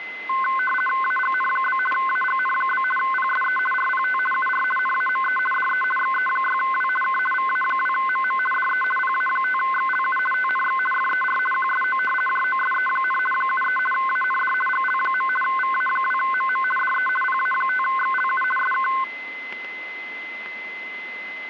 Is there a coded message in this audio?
Yes: RTTY (50 baud, 450 Hz shift) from 0.3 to 19.0 s, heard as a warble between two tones, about 1290 Hz centre, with static crashes and a steady whistle near 2050 Hz. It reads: AGN? AGN? PSE RPT UR NAME DE XE6W K VA2MM DE PA5XLU TNX FER QSO JOSE, 73 AND GL. VA2MM DE PA5XLU SK